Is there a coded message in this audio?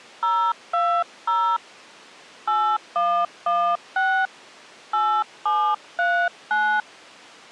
Yes: DTMF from 0.2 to 6.8 s, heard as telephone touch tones, dialled by hand, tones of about 290 ms. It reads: 020 8116 8739